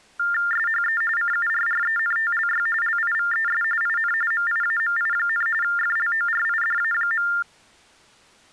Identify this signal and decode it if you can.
TTY/TDD text telephone tones (45.45 baud Baudot), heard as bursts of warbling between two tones, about 400 Hz shift, 1600 Hz centre. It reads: SHE CURRENTLY LIVES IN MIAMI, FLORIDA.